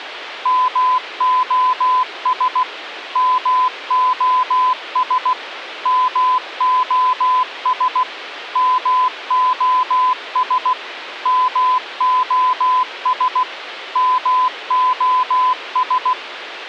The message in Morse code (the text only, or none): MOS MOS MOS MOS MOS MOS